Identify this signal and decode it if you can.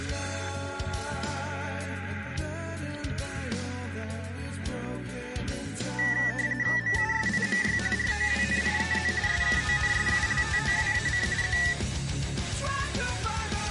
RTTY (45.45 baud, 170 Hz shift), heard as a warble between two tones, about 1850 Hz centre, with static crashes. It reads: MUSIMY ROWNIEZ SKONSULTOWAC Z